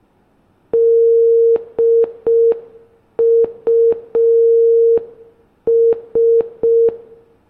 Morse code, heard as a keyed tone, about 5 wpm, 460 Hz, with room echo. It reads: DUS